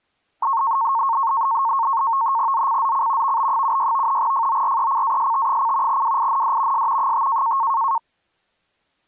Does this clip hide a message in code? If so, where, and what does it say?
Yes: NAVTEX (SITOR-B), 100 baud, 170 Hz shift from 0.4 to 8.0 s, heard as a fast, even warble, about 1000 Hz centre. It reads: ZCZC VB76 FORECAST: WIND S 5